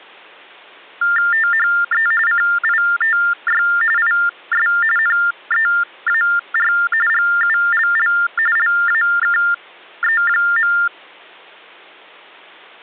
TTY/TDD text telephone tones (45.45 baud Baudot), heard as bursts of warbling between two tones, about 400 Hz shift, 1600 Hz centre. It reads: THE CITY IS NEAR GULL LAKE.